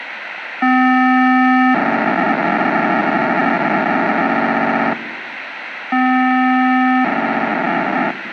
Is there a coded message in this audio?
Yes: POCSAG pager data (512 baud) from 0.6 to 8.1 s, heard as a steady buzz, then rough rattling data, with radio hiss.